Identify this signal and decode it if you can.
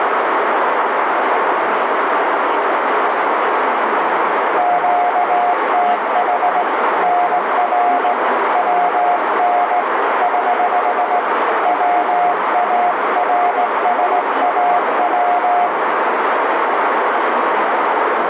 Morse code, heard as a keyed tone, hand-sent with a straight key, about 18 wpm, 710 Hz, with heavy radio static, a narrow filter and speech in English. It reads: QTH NR WN <HH> WARSAW